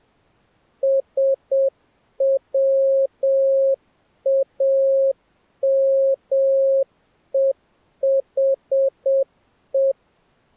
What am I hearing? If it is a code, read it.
Morse code, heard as a keyed tone, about 7 wpm, 540 Hz. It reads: SWAMEHE